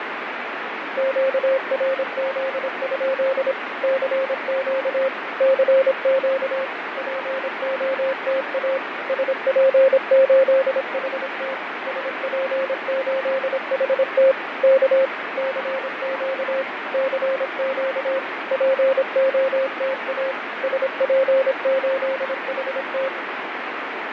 Morse code, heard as a keyed tone, machine-sent, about 26 wpm, 530 Hz, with heavy radio static and fading. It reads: QRZ? CQ CQ POTA SP8HT SP8HT K CQ CQ POTA SP8HT